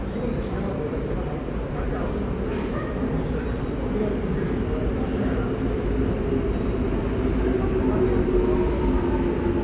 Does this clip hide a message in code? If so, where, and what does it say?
No, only the noise of a subway station.